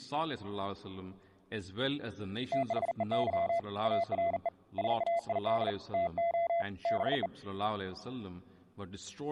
Morse code, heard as a keyed tone, hand-sent with a bug key, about 40 wpm, 680 Hz. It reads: THEY ARE SAID TO BE